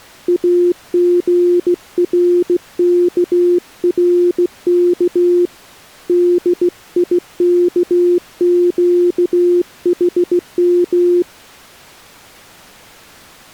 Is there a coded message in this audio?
Yes: Morse code (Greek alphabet) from 0.2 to 11.3 s, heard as a keyed tone, hand-sent with a straight key, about 16 wpm, 350 Hz. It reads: ΑΓΡΚΡΚ ΔΙΚΨΗΜ